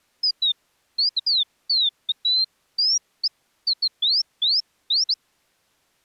Bird-like chirps. There is no code.